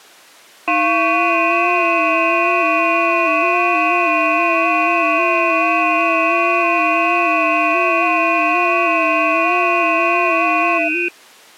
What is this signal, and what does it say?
FT8 (several signals at once), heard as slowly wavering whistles, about 6.25 baud.